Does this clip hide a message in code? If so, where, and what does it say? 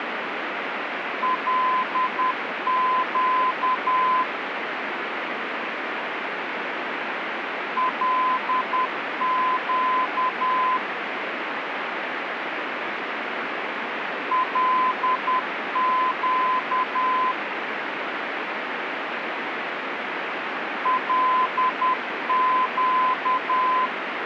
Yes: Morse code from 1.2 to 23.9 s, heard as a keyed tone, machine-sent, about 10 wpm, 1020 Hz, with radio static. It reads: LQ LQ LQ LQ